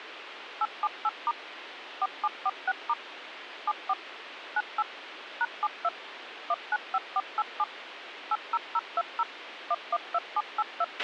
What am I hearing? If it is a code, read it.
DTMF, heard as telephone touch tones, dialled by machine, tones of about 40 ms, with radio hiss and a squelch burst at the end. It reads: 878* 4746* 74 98 #72 195487 80020 112782